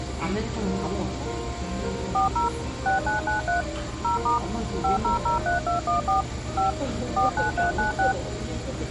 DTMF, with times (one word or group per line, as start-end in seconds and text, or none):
2.1-2.5 40
2.9-3.6 6993
4.0-4.4 0*
4.8-6.2 5003214
6.6-6.7 5
7.2-8.1 49396